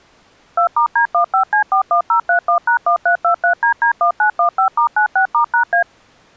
DTMF, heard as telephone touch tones, dialled by machine, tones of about 100 ms. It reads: 2*D15C41031#1323DD1915*96*#A